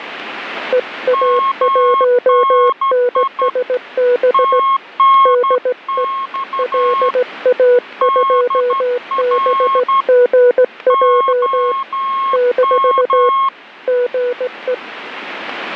Morse code, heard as two keyed tones, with radio static. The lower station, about 17 wpm, 490 Hz: EA1NSB DE LA2BGJ - GE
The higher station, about 12 wpm, 1080 Hz: MNI TNX DR OM